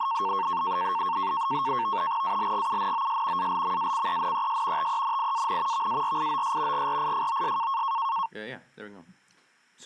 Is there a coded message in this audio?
Yes: NAVTEX (SITOR-B), 100 baud, 170 Hz shift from 0.0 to 8.3 s, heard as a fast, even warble, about 1000 Hz centre, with speech in English. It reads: ALGUNOS ALMACENES TENIAN VARIOS GRIFOS